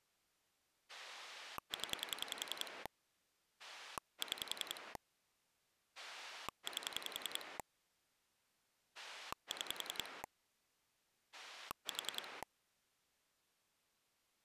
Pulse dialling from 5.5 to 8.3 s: 8

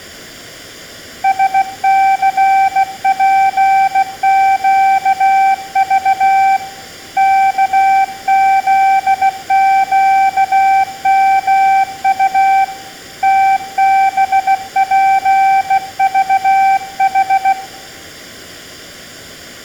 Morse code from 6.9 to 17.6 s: KZQMU TBPVH

